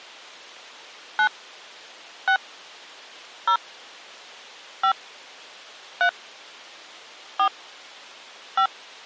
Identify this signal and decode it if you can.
DTMF, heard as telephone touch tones, dialled by hand, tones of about 80 ms. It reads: 9 6 0 5 3 4 5